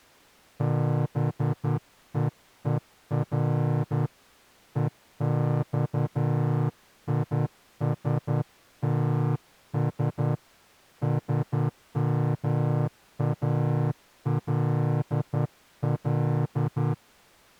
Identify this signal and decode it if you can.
Morse code, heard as a horn, hand-sent with a straight key, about 10 wpm. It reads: BEER EXISTS SMALL